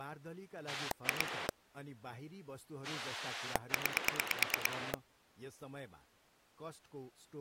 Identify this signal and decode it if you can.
Pulse dialling, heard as a rotary dial, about 9 pulses a second, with speech in Nepali. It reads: 2 9